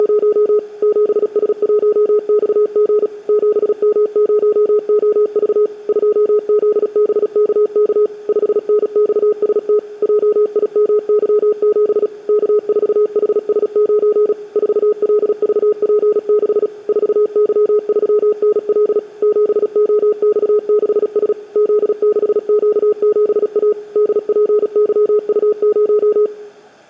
Morse code, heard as a keyed tone, machine-sent, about 36 wpm, 420 Hz, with room echo. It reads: … 7S1XG 7M0OV 2ZBKK 5NXST JIMY7 K4HS9 4LVP6 4Y3NL 7OX6S Z6Q7A DPYU0